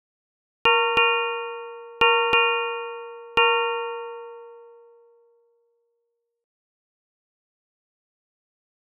Ship's bell, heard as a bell. 5. Five half-hours of the watch have passed.